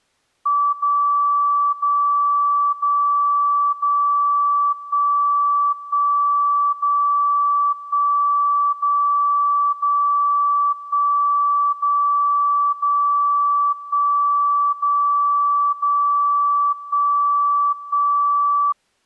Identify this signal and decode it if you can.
Radio time signal (DCF77), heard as a tone whose level steps once a second, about 1160 Hz. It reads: 0 0 0 0 1 1 0 1 0 0 1 0 0 1 0 0 1 1